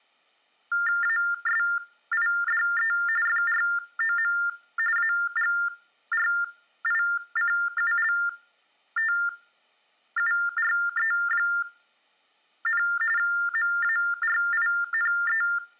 TTY/TDD text telephone tones (45.45 baud Baudot), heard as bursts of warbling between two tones, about 400 Hz shift, 1600 Hz centre, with room echo. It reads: ASIDE FROM AGRICULTURE, MARINE